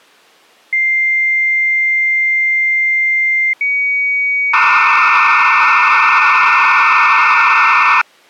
Dial-up modem handshake (low-speed, two carriers), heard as two whistles, then hiss.